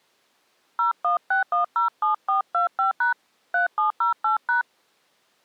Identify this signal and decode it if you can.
DTMF, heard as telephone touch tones, dialled by hand, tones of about 120 ms. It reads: 016107425# 3708#